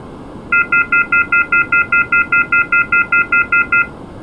Telephone call progress tone (North American plan), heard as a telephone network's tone, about 1400, 2050, 2450, 2600 Hz, 0.1 s on and 0.1 s off. Off-hook warning tone.